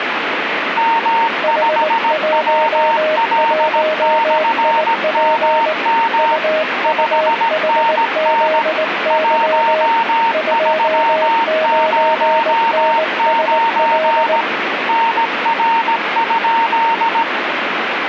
Morse code, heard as two keyed tones, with radio static. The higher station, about 17 wpm, 920 Hz: M5WL/MM 5NN 1309 NR?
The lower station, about 19 wpm, 630 Hz: H11IP UUHZY 29NSL